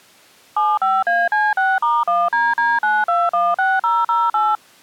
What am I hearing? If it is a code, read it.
DTMF, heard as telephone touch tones, dialled by machine, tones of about 210 ms. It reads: 75AC6*1DD9216008